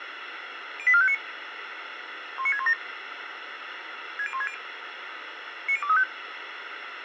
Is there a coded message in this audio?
Yes: five-tone selective call (ZVEI) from 0.8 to 6.0 s, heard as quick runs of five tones, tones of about 70 ms, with radio hiss and a squelch burst at the end. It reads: 08459 19617 60160 90235